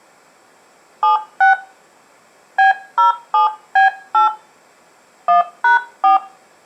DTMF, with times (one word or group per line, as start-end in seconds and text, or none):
1.0-1.5 76
2.6-4.3 B07B8
5.3-6.2 1#4